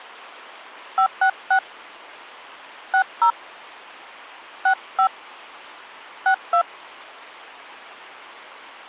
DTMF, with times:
1.0-1.6 566
2.9-3.3 60
4.7-5.1 65
6.3-6.6 62

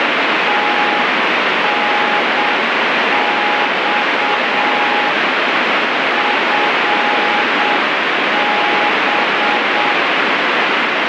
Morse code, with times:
0.5-5.1 TNX
6.2-9.9 FB

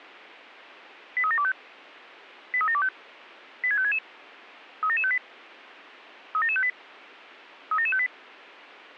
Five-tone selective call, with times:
1.2-1.5 83725
2.5-2.9 83725
3.6-4.0 86566
4.8-5.2 37758
6.3-6.7 37758
7.7-8.1 37758

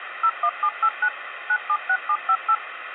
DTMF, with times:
0.2-1.1 01789
1.5-2.5 976758

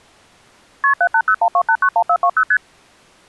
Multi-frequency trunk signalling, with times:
0.8-0.9 KP
1.0-2.4 78012891420
2.5-2.6 ST

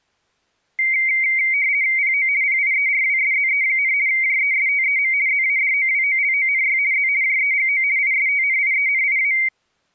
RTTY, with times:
2.0-2.3 PO
2.4-3.9 PIERWSZE,
4.1-5.1 JESTEM
5.3-6.8 ZADOWOLONY
6.9-7.1 Z
7.2-7.8 JEGO
8.0-9.3 ISTNIENIA

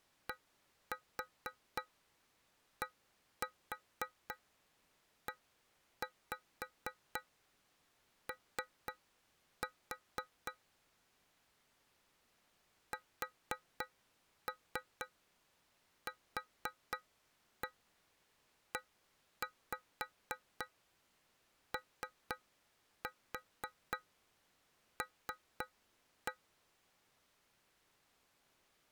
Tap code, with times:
0.3-10.5 DDEO
12.9-26.3 SQEOL

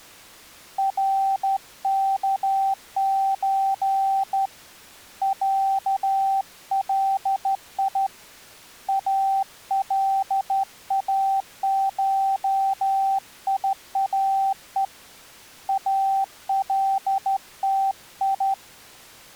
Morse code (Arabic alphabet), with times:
0.8-4.5 ركز
5.2-8.1 علي
8.9-14.8 الاشياء
15.7-18.5 التي

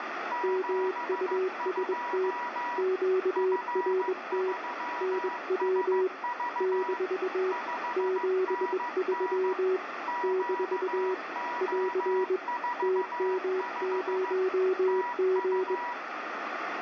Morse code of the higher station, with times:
0.3-2.8 72
3.4-7.0 F3SV
7.5-9.5 5NN
10.1-14.3 QO45
14.9-15.9 TU

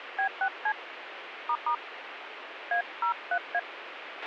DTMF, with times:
0.2-0.7 B6C
1.5-1.7 **
2.7-3.6 A03A

